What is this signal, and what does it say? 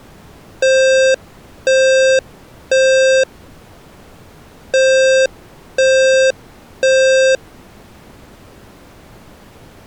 Alarm pattern, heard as an alarm's beeps, played twice, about 530 Hz. Temporal three. Smoke or fire, evacuate.